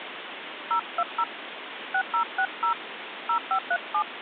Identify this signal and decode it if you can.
DTMF, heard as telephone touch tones, dialled by hand, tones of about 70 ms, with phone line noise. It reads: 020 6060 0537